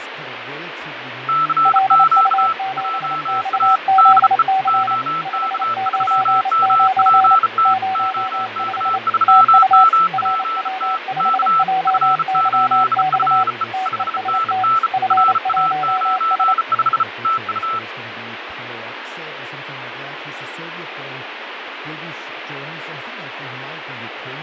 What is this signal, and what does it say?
Morse code, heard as two keyed tones, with radio static, fading and speech in English. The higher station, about 34 wpm, 1320 Hz: CQ JA DE OK3MPT OK3MPT K F8FE 5NN RA95 TU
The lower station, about 28 wpm, 760 Hz: LU7XZC 599 05 TU RW5JYX TEST F1S